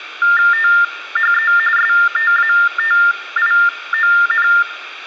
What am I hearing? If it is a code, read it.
TTY/TDD text telephone tones (45.45 baud Baudot), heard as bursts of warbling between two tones, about 400 Hz shift, 1600 Hz centre, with phone line noise and room echo. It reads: THE STATION